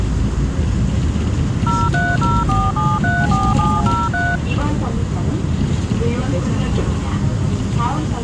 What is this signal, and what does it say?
DTMF, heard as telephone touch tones, dialled by machine, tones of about 220 ms, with the noise inside a bus. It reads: 0304734703